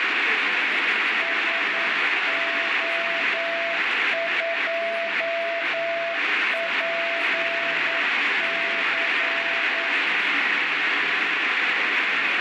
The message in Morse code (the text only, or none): SO2PC